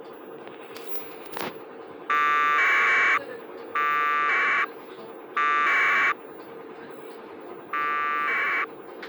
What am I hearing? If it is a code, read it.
Packet radio (AX.25, as in APRS), 1200 baud, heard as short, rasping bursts, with the noise inside a bus.